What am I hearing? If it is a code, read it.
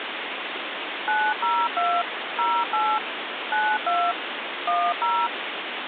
DTMF, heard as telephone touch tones, dialled by machine, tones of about 250 ms, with phone line noise. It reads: 902 08 92 10